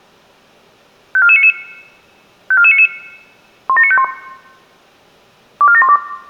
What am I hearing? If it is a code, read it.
Five-tone selective call (ZVEI), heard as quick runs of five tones, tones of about 70 ms, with room echo. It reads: 54499 54499 17951 24712